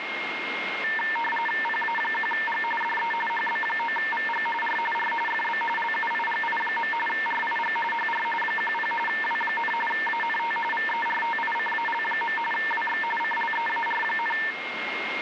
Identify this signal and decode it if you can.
RTTY (45.45 baud, 850 Hz shift), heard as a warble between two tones, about 1350 Hz centre, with radio static and a steady whistle near 2140 Hz. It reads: PA1G DE HB9VG R R FB LUIGI. RIG HR 10 W, ANT VERTICAL. WX CLEAR,